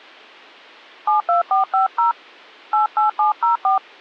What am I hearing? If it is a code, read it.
DTMF, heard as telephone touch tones, dialled by hand, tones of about 130 ms. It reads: 72450 88704